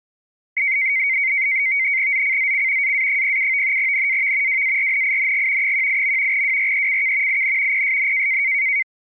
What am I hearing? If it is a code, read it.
NAVTEX (SITOR-B), 100 baud, 170 Hz shift, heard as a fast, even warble, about 2150 Hz centre. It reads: ZCZC AA07 NAV WARNING 18. WRECK IN PSN